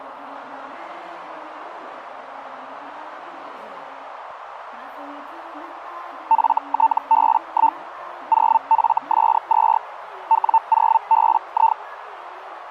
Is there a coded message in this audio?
Yes: Hellschreiber (Feld-Hell, 122.5 baud) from 6.3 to 11.8 s, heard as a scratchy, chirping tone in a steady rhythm, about 900 Hz, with radio static. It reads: FTB1 0FS2 W0BI